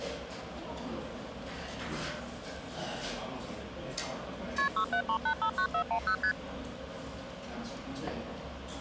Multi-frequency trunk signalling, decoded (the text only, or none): KP 673859410 ST